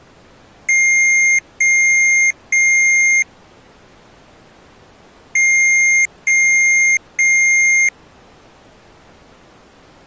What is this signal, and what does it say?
Beep code, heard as beeps from a small speaker, played twice, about 2100 Hz. 3 long. In IBM BIOS tables: keyboard card error.